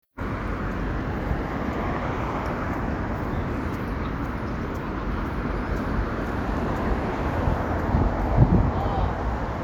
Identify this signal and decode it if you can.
Street noise. There is no code.